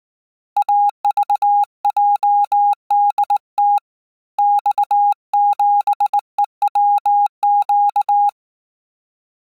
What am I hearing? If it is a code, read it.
Morse code, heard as a keyed tone, hand-sent with a straight key, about 19 wpm, 820 Hz. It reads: AVJDT X7EWQ